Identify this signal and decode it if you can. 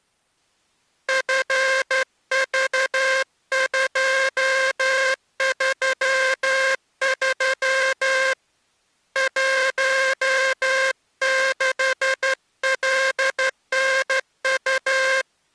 Morse code, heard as a buzzer, hand-sent with a straight key, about 12 wpm. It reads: FV233 16LNU